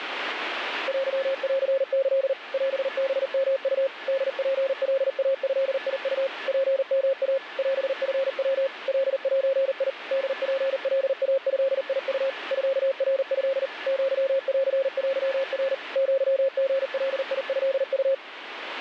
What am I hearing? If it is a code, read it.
Morse code (Japanese Wabun code), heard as a keyed tone, machine-sent, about 39 wpm, 540 Hz, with radio static and a weaker station near 1730 Hz. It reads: テンキ オハヨウ ホツカイドウ ツヨイ オチヤ カゼ ホツカイドウ ミナト アンテナ アリガトウ